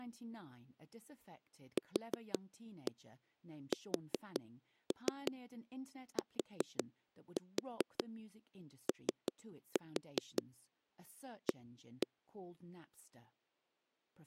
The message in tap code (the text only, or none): QSTOA